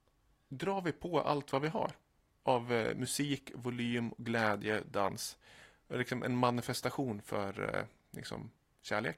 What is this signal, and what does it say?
Speech in Swedish. There is no code.